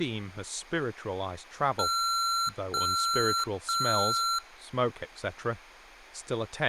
Beep code, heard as beeps from a small speaker, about 1360 Hz, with speech in English. 3 long. In IBM BIOS tables: keyboard card error.